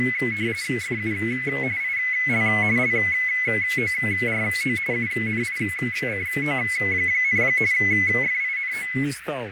RTTY (45.45 baud, 170 Hz shift), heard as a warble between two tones, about 2100 Hz centre, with radio static, fading, a narrow filter and speech in Russian. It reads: FU IL LORO UNICO, FINO